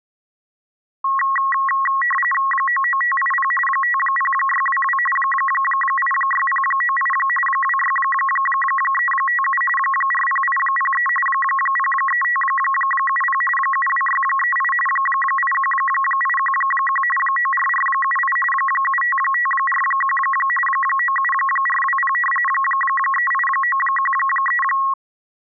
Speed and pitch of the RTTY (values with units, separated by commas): 45.45 baud, 850 Hz shift, 1500 Hz centre